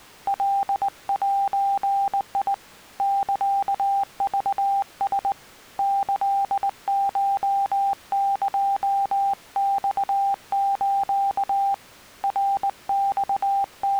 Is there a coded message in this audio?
Yes: Morse code (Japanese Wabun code) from 0.2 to 14.0 s, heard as a keyed tone, hand-sent with a straight key, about 19 wpm, 790 Hz. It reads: カゼ サクラ キコエマス …